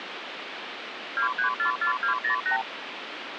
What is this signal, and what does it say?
Multi-frequency trunk signalling (R2, with the far end's replies), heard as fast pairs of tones, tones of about 110 ms, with phone line noise. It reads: 2344208